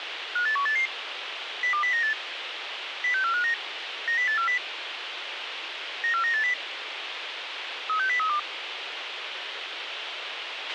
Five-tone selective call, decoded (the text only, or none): 58188 02098 06459 90840 94980 36032